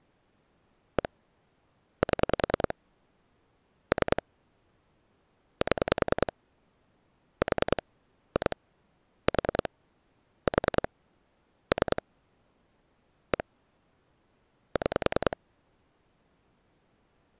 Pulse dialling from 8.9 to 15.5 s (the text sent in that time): 4 4 3 1 6